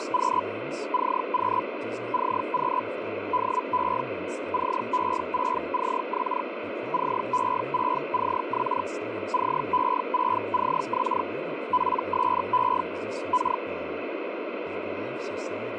Hellschreiber (Feld-Hell, 122.5 baud), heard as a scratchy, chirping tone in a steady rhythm, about 1000 Hz, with radio static and speech in English. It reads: … CQ CQ DE CE6CX CE6CX CE6CX PSE K